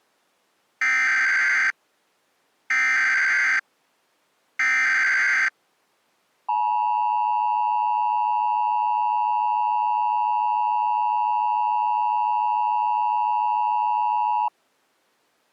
Emergency Alert System (SAME) tones (header bursts, then the 853 and 960 Hz attention tone), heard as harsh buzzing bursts, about 520.83 baud.